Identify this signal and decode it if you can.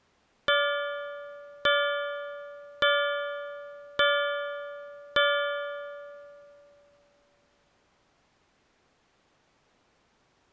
Clock strike, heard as a bell. 5. Five o'clock.